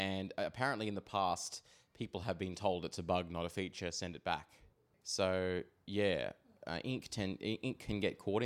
Speech in English. There is no code.